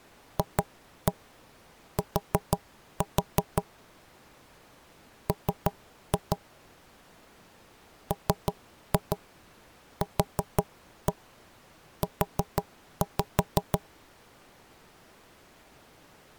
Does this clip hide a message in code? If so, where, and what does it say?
Yes: tap code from 0.4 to 13.8 s, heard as knocks on wood, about 6 knocks a second. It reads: FT M MQU